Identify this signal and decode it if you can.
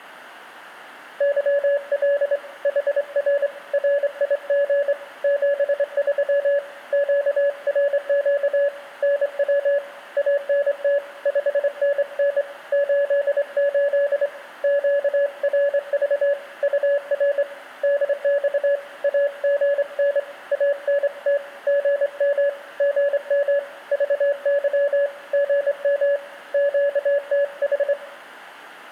Morse code, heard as a keyed tone, hand-sent with a straight key, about 25 wpm, 570 Hz, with room echo. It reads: YL HR RIG 73 QRQ NW ANT 5NN 88 QRV UR DX AGN ANT GM GM VY GM QTH